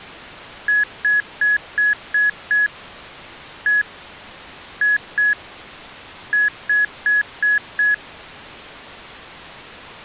Beep code, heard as beeps from a small speaker, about 1700 Hz. 6-1-2-5.